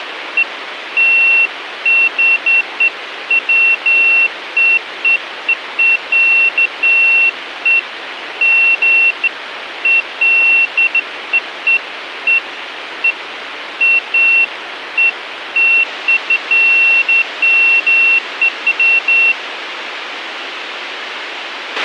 Beeps of irregular length, with radio hiss and a squelch burst at the end. There is no code.